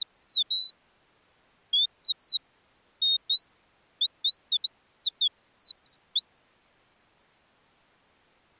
Bird-like chirps. There is no code.